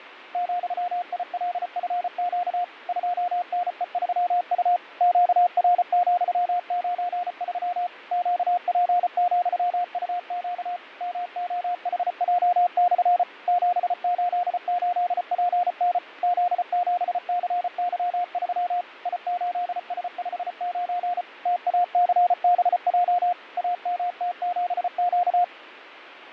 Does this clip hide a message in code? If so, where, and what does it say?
Yes: Morse code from 0.3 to 25.5 s, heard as a keyed tone, machine-sent, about 34 wpm, 710 Hz, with radio static and fading. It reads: ,ILFQ 2NE3U QR,93 QP,UQ MOHJ/ 788PN Z7CY3 I8S59 TACBJ AMT7Q